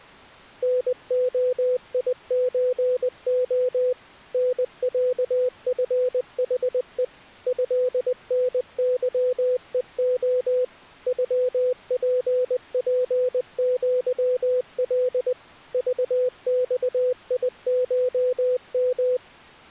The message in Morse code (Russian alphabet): НОИЧО НЯФХЕ ЭНЫЕО ЮППЪЛ ЖЬИШМ

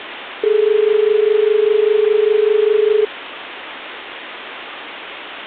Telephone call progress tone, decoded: dial tone

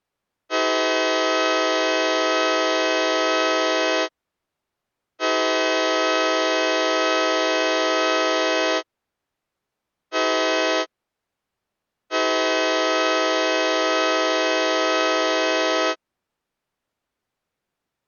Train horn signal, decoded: 2 long, 1 short, 1 long

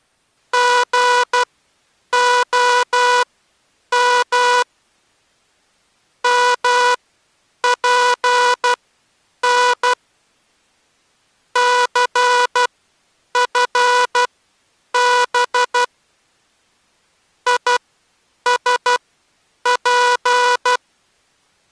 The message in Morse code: GOM MPN CFB ISP

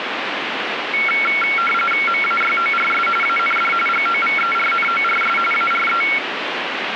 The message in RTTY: MAYORS AND GOVERNORS ARE

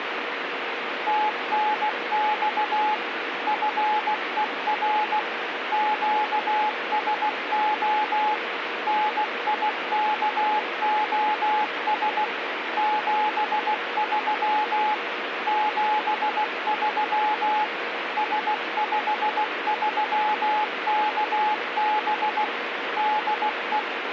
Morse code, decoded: TNX FER QSO NIKOS 73 73 S53KB DE

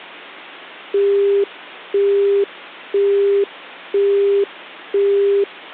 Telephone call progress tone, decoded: busy tone

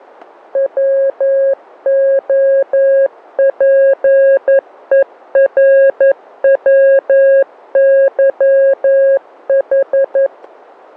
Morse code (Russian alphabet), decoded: ВОПЕРВЫХ

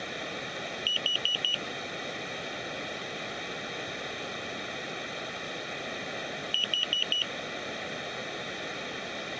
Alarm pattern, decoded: temporal four

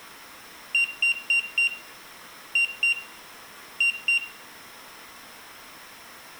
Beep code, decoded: 4-2-2

